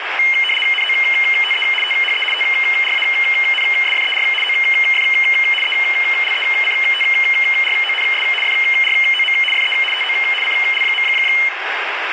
RTTY (75 baud, 850 Hz shift), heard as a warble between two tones, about 2550 Hz centre, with radio static. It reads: NOTE THE TRANSFER OF ELECTRONS FROM FE TO CL.